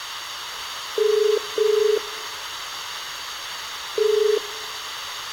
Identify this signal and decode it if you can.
Telephone call progress tone (as in the UK, Ireland, Australia and similar networks), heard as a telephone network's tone, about 430 Hz, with room echo. Ringback tone.